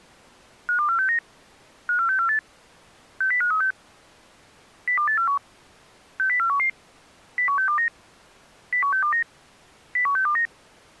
Five-tone selective call (CCIR), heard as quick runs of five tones, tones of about 100 ms. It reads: 52469 54648 60536 02841 60411 01629 01629 01629